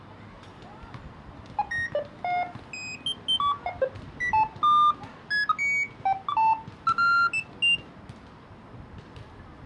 Electronic bleeps of random pitch and length, with the noise of a residential street. There is no code.